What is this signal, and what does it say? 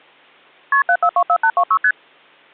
Multi-frequency trunk signalling (R1, as on North American trunks), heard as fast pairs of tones, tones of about 70 ms. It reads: KP 7424826 ST